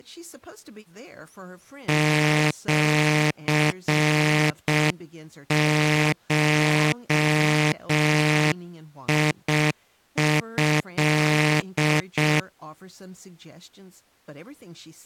Morse code (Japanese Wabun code), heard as a buzzer, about 6 wpm, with speech in English. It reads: シゴト